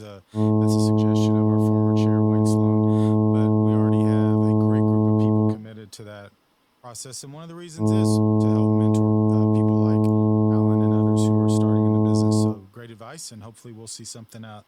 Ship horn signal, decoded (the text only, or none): 2 long